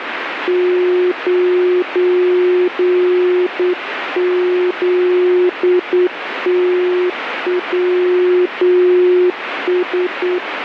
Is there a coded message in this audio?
Yes: Morse code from 0.4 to 10.4 s, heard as a keyed tone, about 8 wpm, 360 Hz, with radio static. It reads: 9ZTWS